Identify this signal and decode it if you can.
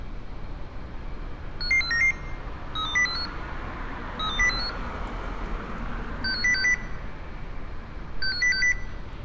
Five-tone selective call (CCIR), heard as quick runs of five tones, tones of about 100 ms, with street noise. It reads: 55499 32045 32045 65060 65060